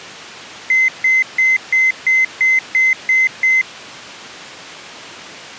Beep code, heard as beeps, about 2050 Hz. 9 short. In AMI BIOS tables: ROM checksum failure.